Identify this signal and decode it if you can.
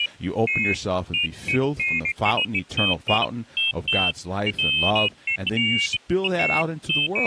Pairs of high tones at irregular times, with speech in English. There is no code.